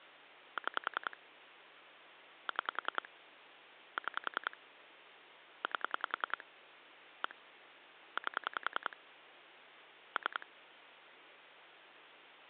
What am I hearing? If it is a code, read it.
Pulse dialling, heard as clicks on a phone line, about 10 pulses a second. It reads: 6 6 6 8 1 8 3